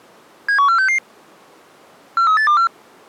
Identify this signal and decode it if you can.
Five-tone selective call (CCIR), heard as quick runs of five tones, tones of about 100 ms. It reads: 71466 43824